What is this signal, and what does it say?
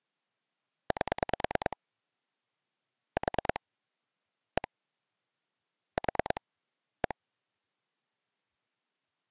Pulse dialling, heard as clicks on a phone line, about 9 pulses a second. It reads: 8 4 1 4 1